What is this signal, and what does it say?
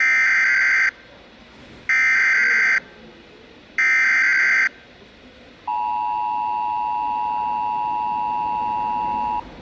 Emergency Alert System (SAME) tones (header bursts, then the 853 and 960 Hz attention tone), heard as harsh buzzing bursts, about 520.83 baud, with the noise of a subway station.